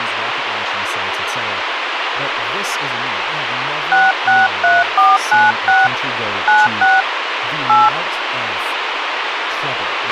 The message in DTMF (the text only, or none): 663496 96 8